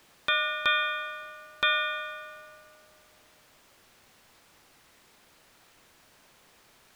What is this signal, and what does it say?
Ship's bell, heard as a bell. 3. Three half-hours of the watch have passed.